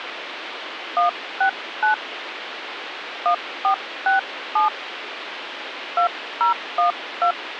DTMF, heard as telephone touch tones, dialled by hand, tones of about 120 ms, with phone line noise. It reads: 169 1467 2012